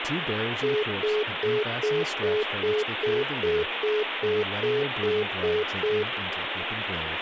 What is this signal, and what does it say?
Telephone call progress tone (single-tone plan, as in most of Europe), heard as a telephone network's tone, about 420 Hz, 0.2 s on and 0.2 s off, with phone line noise and speech in English. Congestion tone.